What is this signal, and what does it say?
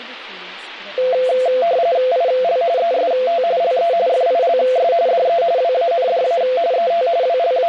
RTTY (45.45 baud, 170 Hz shift), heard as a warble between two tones, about 600 Hz centre, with speech in English. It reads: IL EST LE FILS DE WANDA ET …